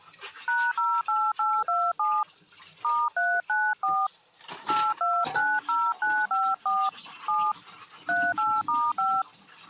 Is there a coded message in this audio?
Yes: DTMF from 0.5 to 9.2 s, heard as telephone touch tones, dialled by hand, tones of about 240 ms, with kitchen noise. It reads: #08827 *394 8290954 7 38*5